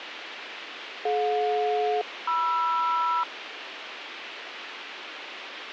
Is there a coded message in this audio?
Yes: aircraft SELCAL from 1.1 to 3.2 s, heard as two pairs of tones, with radio hiss. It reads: DJ-MR